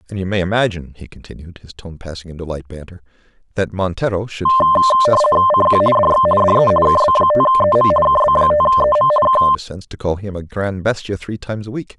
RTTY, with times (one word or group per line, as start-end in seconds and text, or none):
5.5-5.8 CQ
6.0-6.3 DX
6.4-6.7 DE
6.9-7.9 KB5EM
8.1-9.1 KB5EM
9.3-9.4 K